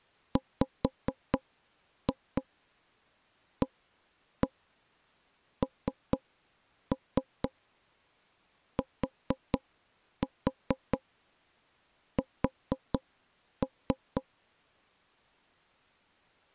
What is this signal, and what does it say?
Tap code, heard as knocks on wood, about 4 knocks a second. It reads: WANTS